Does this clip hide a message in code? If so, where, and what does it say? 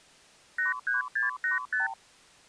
Yes: multi-frequency trunk signalling (R2, with the far end's replies) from 0.6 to 1.9 s, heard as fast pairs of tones, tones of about 140 ms. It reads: 83685